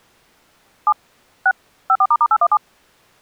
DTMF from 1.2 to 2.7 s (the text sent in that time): 6 54**817